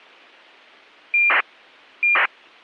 ACARS aircraft data, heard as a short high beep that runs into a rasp, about 2400 baud.